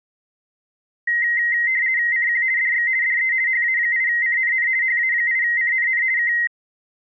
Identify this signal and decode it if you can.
RTTY (50 baud, 170 Hz shift), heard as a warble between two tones, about 2000 Hz centre. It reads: CQ DX DE HA8CNN HA8CNN K